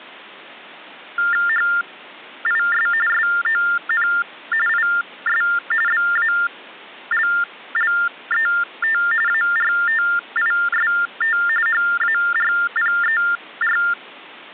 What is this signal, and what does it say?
TTY/TDD text telephone tones (45.45 baud Baudot), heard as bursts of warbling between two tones, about 400 Hz shift, 1600 Hz centre. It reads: HIS SON IS BALLET ARTIST HARPER